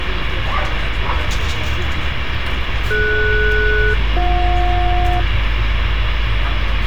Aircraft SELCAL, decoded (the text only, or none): DS-BJ